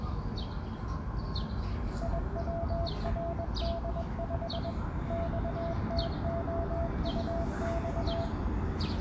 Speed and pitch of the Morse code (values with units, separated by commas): 21 wpm, 670 Hz